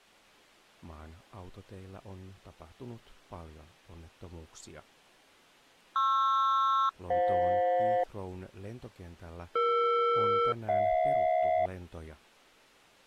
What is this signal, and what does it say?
Aircraft SELCAL, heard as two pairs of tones, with speech in Finnish. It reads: PR-FJ ER-HJ